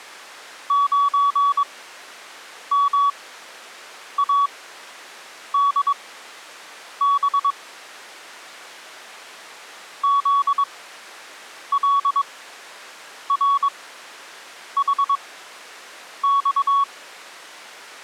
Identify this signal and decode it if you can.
Morse code, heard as a keyed tone, machine-sent, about 22 wpm, spaced as for 7 wpm, 1120 Hz. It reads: 9MADB ZLRHX